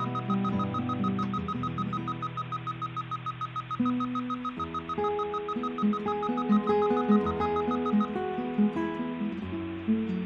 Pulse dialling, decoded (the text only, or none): none